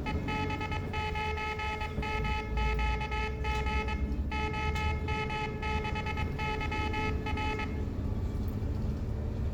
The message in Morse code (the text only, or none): EB9MQG OM6YR